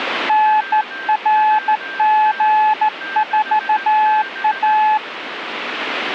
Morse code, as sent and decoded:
-. .-. --. ....- .-
NRG4A

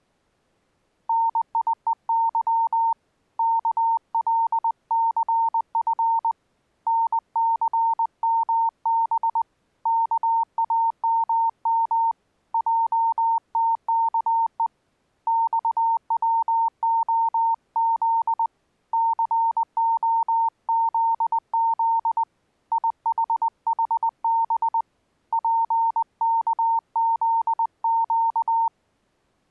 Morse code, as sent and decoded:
-. .. . -.-- / -.- .-.. -.-. ..-. / -. -.-. -- -... / -.- .- -- -- / .--- - -.- . / -..- .-- --- --.. / -.-. --- --.. --.. / .. .... .... -... / .--. -.- --.. --.-
NIEY KLCF NCMB KAMM JTKE XWOZ COZZ IHHB PKZQ

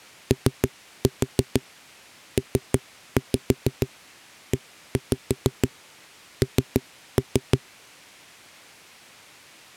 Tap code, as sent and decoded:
3-4 3-5 1-5 3-3
OPEN

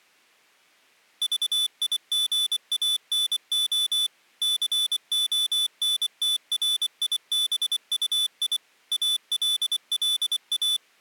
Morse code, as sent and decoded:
...- .. --. .- -. --- / -.-. --- -. - .-. .. -... ..- .. / .- .-.. .-.. .-
VIGANO CONTRIBUI ALLA

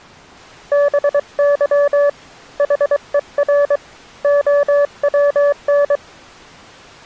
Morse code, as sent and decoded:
-... -.-- / .... . .-. / --- .-- -.
BY HER OWN

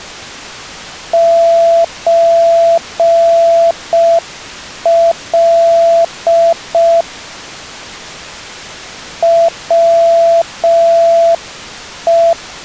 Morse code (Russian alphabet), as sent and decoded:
---. .-.. / .-- .
ЧЛ ВЕ

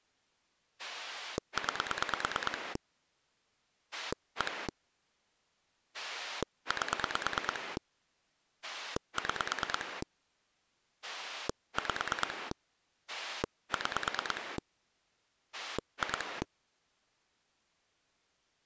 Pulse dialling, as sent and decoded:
9 / 1 / 8 / 6 / 5 / 6 / 2
9 1 8 6 5 6 2

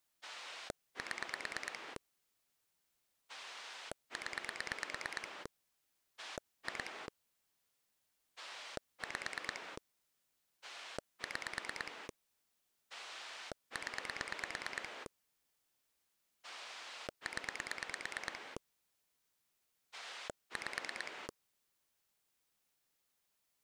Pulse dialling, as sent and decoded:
7 / 10 / 2 / 5 / 6 / 10 / 10 / 5
7 0 2 5 6 0 0 5

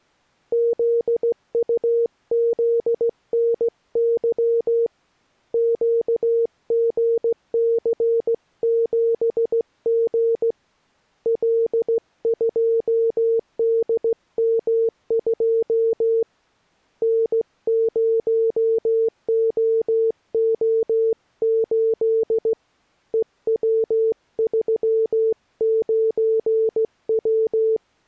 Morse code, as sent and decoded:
--.. ..- --.. -. -.-- / --.- --. -.-. --... --. / .-.. ..--- -.. -- ..--- / -. ----- --- --- ---.. / . .-- ...-- ----. .--
ZUZNY QGC7G L2DM2 N0OO8 EW39W

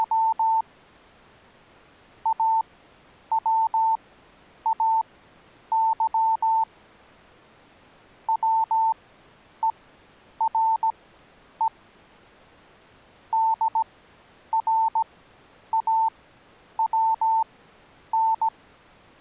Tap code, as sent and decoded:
none

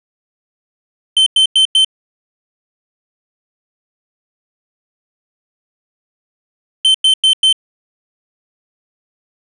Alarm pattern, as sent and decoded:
4 beeps and a pause
temporal four

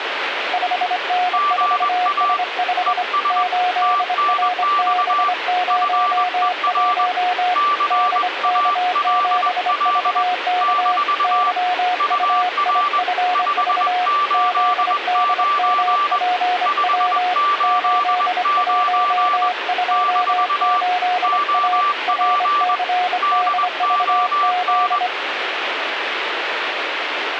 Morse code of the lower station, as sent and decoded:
..... -. ....- ... ..... / ---.. .-. -... ----- .---- / -.. -.- --... ...- -.- / -.-- ..- .. ..-. ...- / --.. -.. -- .--. .-- / ---.. .---- ..--- ---.. .- / .-. -.-. -.. ...- --..
5N4S5 8RB01 DK7VK YUIFV ZDMPW 8128A RCDVZ

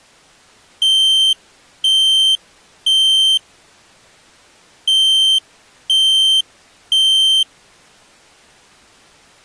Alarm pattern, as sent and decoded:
3 beeps and a pause
temporal three

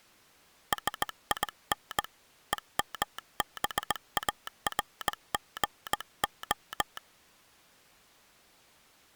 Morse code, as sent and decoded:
... .. -. / . -- -... .- .-. --. ---
SIN EMBARGO

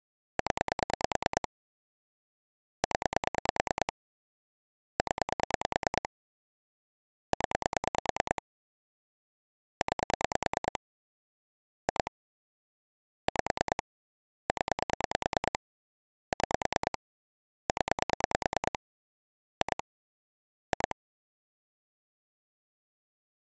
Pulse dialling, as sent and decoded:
10 / 10 / 10 / 10 / 9 / 2 / 5 / 10 / 6 / 10 / 2 / 2
0 0 0 0 9 2 5 0 6 0 2 2

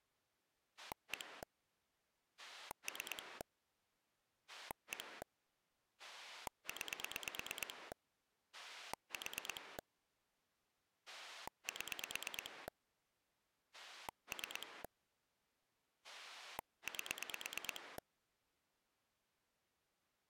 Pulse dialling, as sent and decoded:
1 / 3 / 1 / 9 / 4 / 7 / 3 / 8
1 3 1 9 4 7 3 8

